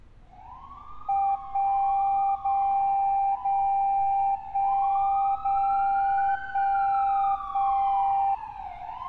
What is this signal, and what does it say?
Radio time signal (DCF77), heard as a tone whose level steps once a second, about 790 Hz, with street noise. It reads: 1 0 0 1 0 1 1